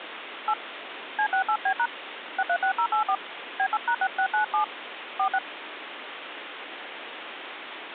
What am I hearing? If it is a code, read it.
DTMF, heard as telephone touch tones, dialled by hand, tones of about 80 ms, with phone line noise. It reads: 8 C68B# 636084 B8#6697 46